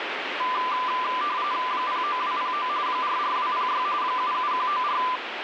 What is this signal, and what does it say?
RTTY (45.45 baud, 170 Hz shift), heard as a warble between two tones, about 1100 Hz centre, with radio static. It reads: 09209 44206 77194